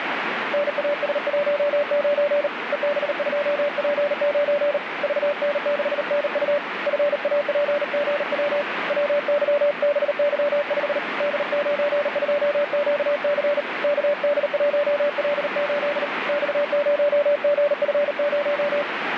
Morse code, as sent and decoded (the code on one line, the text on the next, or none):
-. .- ... .---- ----. / . -... ..--- .--. ----. / ...- -. -.... -. ..- / ..-. .- .--. --. .-- / .-- -.-- -... -.-- ..... / -.. ----. ..--- --.- -.-. / -.- -.. .---- .-.. ---.. / -..- ----- --. ..-. -----
NAS19 EB2P9 VN6NU FAPGW WYBY5 D92QC KD1L8 X0GF0